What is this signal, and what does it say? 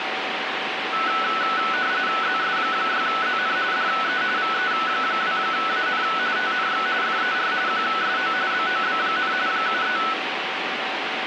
RTTY (45.45 baud, 170 Hz shift), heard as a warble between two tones, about 1400 Hz centre, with radio static. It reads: ZS6ZN DE VE2AN TNX FER QSO BOB, 73